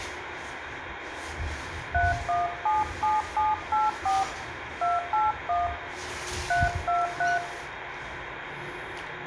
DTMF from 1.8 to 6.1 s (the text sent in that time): 3177784 281